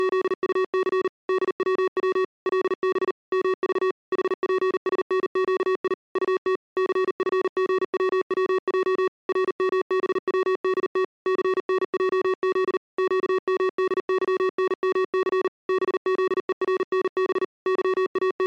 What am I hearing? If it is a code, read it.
Morse code, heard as electronic beeps, machine-sent, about 39 wpm, 380 Hz. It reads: … DWW LB MV HPSNQI UT CFGWWJ RMBWDT CNJZ QMDYNMC BZERNB …